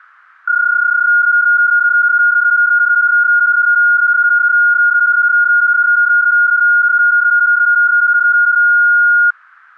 PSK31 (31.25 baud), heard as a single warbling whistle, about 1430 Hz.